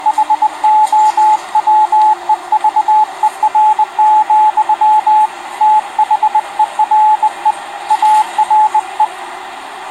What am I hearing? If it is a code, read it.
Morse code, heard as a keyed tone, hand-sent with a bug key, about 20 wpm, 860 Hz, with the noise inside a subway train. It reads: HOWEVER, THERE ARE